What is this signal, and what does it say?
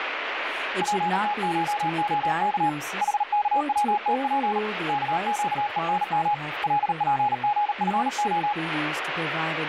Morse code (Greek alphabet), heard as a keyed tone, hand-sent with a paddle, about 38 wpm, 830 Hz, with radio static and speech in English. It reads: ΠΤΧΟΚ ΗΚΩΤΠ ΚΨΕΝΜ ΛΠΓΦΟ